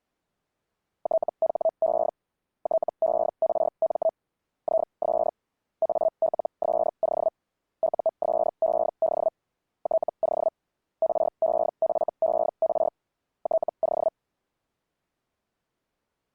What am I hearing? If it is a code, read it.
Hellschreiber (Feld-Hell, 122.5 baud), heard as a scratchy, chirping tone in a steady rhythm, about 650 Hz. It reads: THE TERM IS ALSO USED TO REFER TO